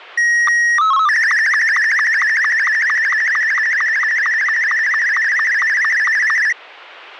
SSTV (slow-scan television), Martin M2, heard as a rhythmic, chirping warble.